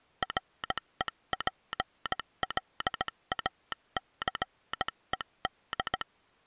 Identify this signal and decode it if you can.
Morse code, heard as a telegraph sounder, hand-sent with a bug key, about 17 wpm. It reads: REPLACED